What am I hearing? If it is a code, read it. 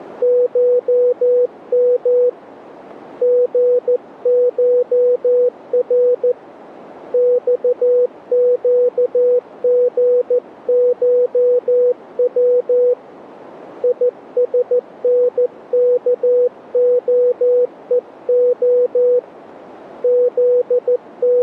Morse code (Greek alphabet), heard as a keyed tone, hand-sent with a paddle, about 14 wpm, 490 Hz. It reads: ΧΜ ΓΧΡ ΞΨΓΧΩ ΙΣΝΚΟΕΟ …